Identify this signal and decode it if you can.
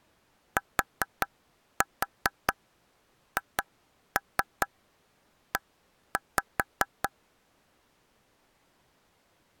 Tap code, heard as taps on a table, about 4 knocks a second. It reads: THE